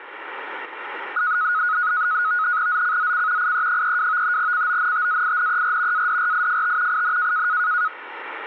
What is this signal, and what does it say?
NAVTEX (SITOR-B), 100 baud, 170 Hz shift, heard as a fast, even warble, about 1360 Hz centre. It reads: ZCZC IE32 CONTAINER ADRIFT IN